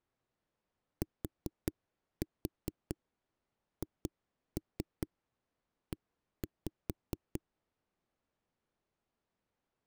Tap code, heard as knocks on a wall, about 4 knocks a second. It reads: THE